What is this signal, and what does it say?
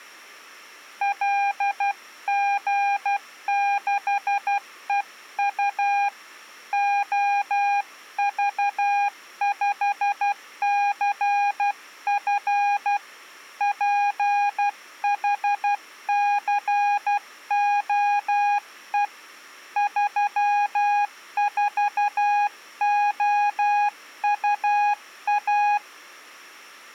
Morse code, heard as a keyed tone, hand-sent with a paddle, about 12 wpm, 810 Hz. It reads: LG6EU OV5CF PHCOE 34OUA